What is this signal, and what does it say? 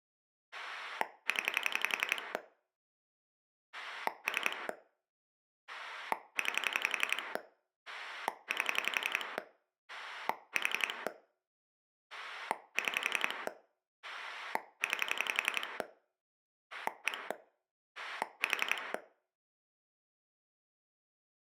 Pulse dialling, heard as a rotary dial, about 11 pulses a second, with room echo. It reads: 0 3 9 8 4 6 9 1 4